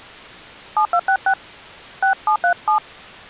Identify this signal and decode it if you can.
DTMF, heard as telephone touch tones, dialled by hand, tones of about 80 ms. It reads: 7266 6737